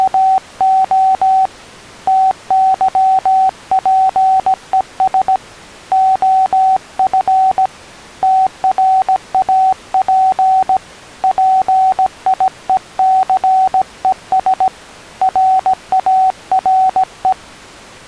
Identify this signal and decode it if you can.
Morse code, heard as a keyed tone, hand-sent with a paddle, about 17 wpm, 760 Hz. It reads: … TYPES OF TRAP PIECES RARE